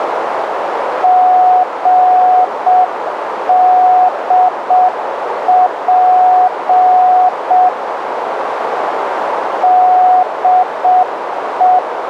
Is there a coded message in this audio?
Yes: Morse code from 1.0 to 11.8 s, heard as a keyed tone, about 6 wpm, 730 Hz, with radio static and a narrow filter. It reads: GDP DE